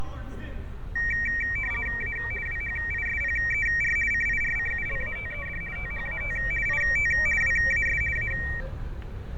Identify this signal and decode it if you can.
RTTY (50 baud, 450 Hz shift), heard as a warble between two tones, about 2100 Hz centre, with fading, static crashes and street noise. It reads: A WHISPER CIRCULATED THAT IT WAS A